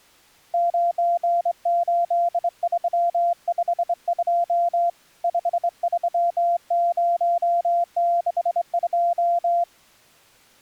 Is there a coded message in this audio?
Yes: Morse code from 0.5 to 9.7 s, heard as a keyed tone, hand-sent with a straight key, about 24 wpm, 690 Hz. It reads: 98352 53062